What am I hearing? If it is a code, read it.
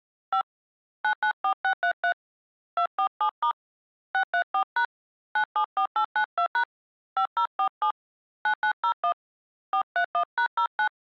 DTMF, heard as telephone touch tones, dialled by hand, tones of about 90 ms. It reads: 5 994633 247* 634# 974892# 5047 9901 431#09